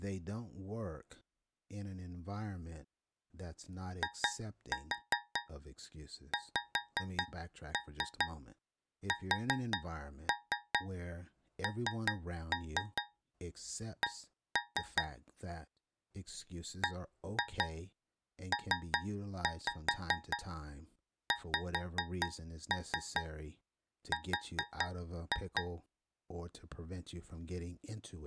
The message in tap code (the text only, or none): IXSNC BPXR